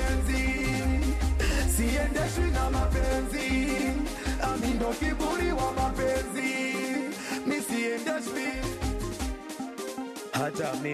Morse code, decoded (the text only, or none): none